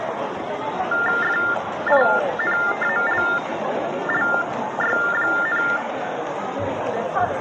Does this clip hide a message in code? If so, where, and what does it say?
Yes: TTY/TDD text telephone tones (45.45 baud Baudot) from 0.9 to 5.8 s, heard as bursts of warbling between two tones, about 400 Hz shift, 1600 Hz centre, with the noise of a crowd indoors. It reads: FINALLY,